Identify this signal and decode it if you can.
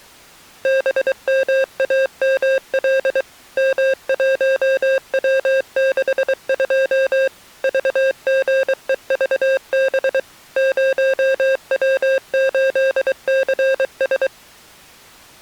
Morse code, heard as electronic beeps, machine-sent, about 23 wpm, 530 Hz. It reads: BMAML M1W62 VGEVB 0W8CS